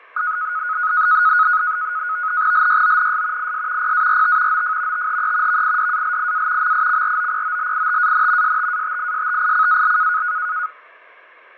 NAVTEX (SITOR-B), 100 baud, 170 Hz shift, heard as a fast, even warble, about 1360 Hz centre, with fading. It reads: LYONS IS PART OF THE VIDALIA MICROPOLITAN STATISTICAL